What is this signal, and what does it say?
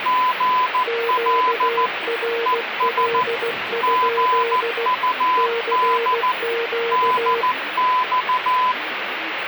Morse code, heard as two keyed tones, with radio static and the noise inside a bus. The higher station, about 14 wpm, 1010 Hz: GL ES GUD DX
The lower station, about 16 wpm, 460 Hz: QRL? CQ